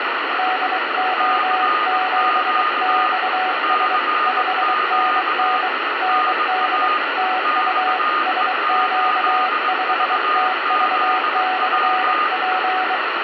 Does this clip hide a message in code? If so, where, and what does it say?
Yes: Morse code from 0.3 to 13.0 s, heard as two keyed tones, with heavy radio static. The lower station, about 23 wpm, 740 Hz: DO7XS 5NN ND TU SQ5TV/P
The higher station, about 20 wpm, 1230 Hz: CQ CQ NA XE8VZW